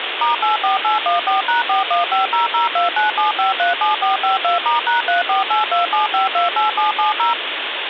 DTMF, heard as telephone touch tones, dialled by machine, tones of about 140 ms, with phone line noise. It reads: *84814#41500297537452*#34827528770